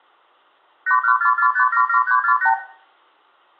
Multi-frequency trunk signalling (R2, with the far end's replies), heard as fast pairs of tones, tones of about 90 ms, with room echo. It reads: 8144577348